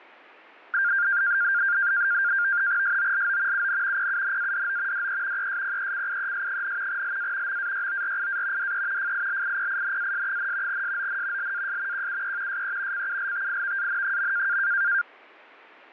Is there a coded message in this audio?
Yes: NAVTEX (SITOR-B), 100 baud, 170 Hz shift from 0.7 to 15.0 s, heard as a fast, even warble, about 1500 Hz centre. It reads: SOLO UN PUNADO DE ESPECIES, LA MAYORIA DE FILIPINAS, SON LAS QUE SE CULTIVAN.